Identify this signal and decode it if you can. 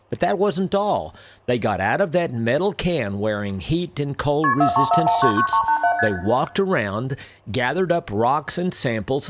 Multi-frequency trunk signalling (R1, as on North American trunks), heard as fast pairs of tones, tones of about 90 ms, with room echo and speech in English. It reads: KP 434199387 ST